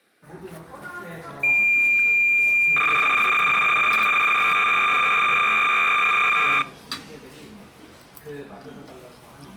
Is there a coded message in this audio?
Yes: cassette data (Kansas City type), 300 baud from 1.4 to 6.6 s, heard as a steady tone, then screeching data, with the noise of a crowd indoors.